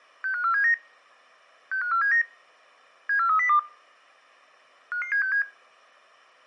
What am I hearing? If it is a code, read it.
Five-tone selective call (CCIR), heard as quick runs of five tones, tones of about 100 ms. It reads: 65479 65479 74302 55767